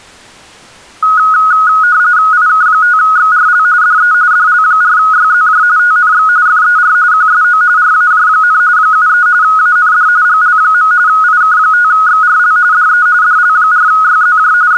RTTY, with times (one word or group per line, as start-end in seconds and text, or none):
2.3-3.6 IK5XRL
3.8-4.1 DE
4.3-5.6 DL4YZJ
5.8-6.3 TNX
6.5-7.0 FER
7.1-7.6 QSO
7.8-8.6 RAJ,
8.8-9.3 73
9.4-10.1 AND
10.3-10.9 GL.
11.1-12.6 IK5XRL
12.7-13.1 DE
13.2-14.5 DL4YZJ
14.7-14.8 …